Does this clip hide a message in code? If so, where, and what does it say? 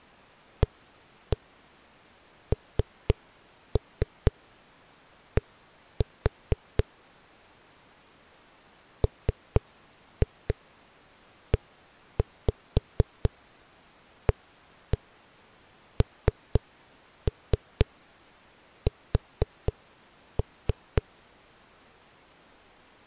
Yes: tap code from 0.6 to 21.0 s, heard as knocks on a wall, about 4 knocks a second. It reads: AND MEANS